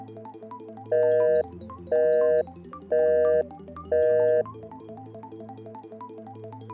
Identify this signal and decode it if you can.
Telephone call progress tone (North American plan), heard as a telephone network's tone, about 480, 620 Hz, 0.5 s on and 0.5 s off. Busy tone.